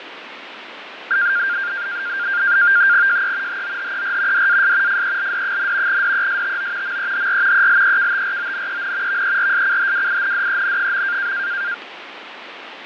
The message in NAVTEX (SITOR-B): JE HOHER DAS FELD, DESTO MEHR ELEKTRONEN VERSCHWINDEN.

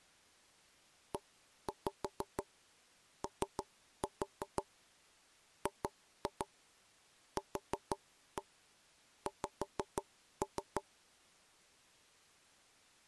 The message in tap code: EOGQX

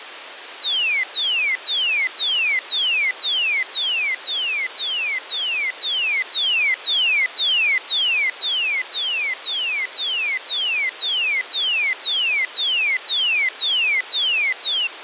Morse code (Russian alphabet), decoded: none

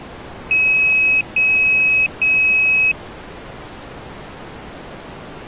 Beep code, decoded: 3 long

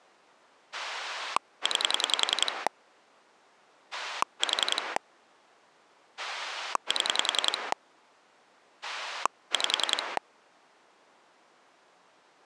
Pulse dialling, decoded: 9 4 7 5

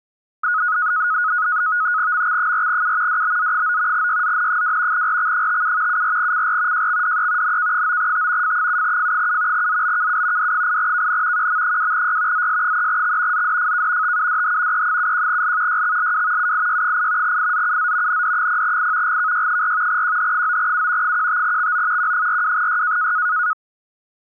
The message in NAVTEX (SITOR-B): MX4U DBZ9 YZN2 RX57 74CR JXDE NK9T F7F7 ZBKU D8KN QM2Y ZS3X ZDFK TUDH E71L YXLW UIY8 IZUZ ND0I GKY4 QH9U 15XO Q42Y

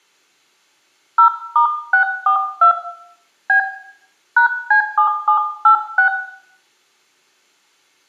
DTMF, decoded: 0*642 B #C7786

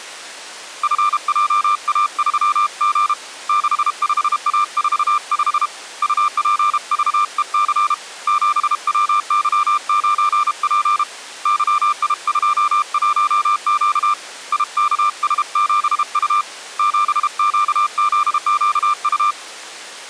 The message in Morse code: FJA3G 65A45 UPVEC 7WY9P YI21Q IKS7U 7QZQU

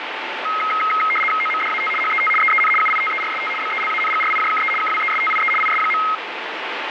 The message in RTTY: OMDAT HET EEN UITERST BELANGRIJKE KWESTIE IS.

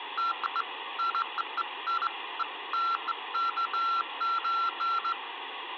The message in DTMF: none

